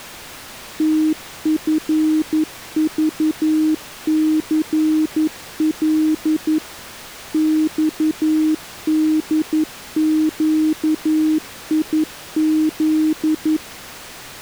Morse code, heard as a keyed tone, machine-sent, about 11 wpm, 310 Hz. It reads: TFVCL XDQIZ